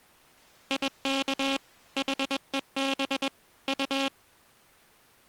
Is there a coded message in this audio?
Yes: Morse code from 0.6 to 4.1 s, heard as a buzzer, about 21 wpm. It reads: IK HEB U